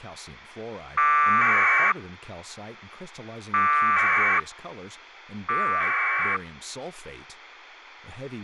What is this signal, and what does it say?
Packet radio (AX.25, as in APRS), 1200 baud, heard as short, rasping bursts, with a squelch burst at the end and speech in English.